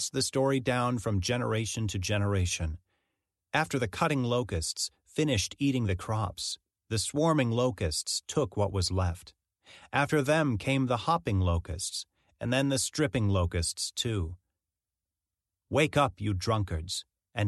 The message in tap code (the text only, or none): none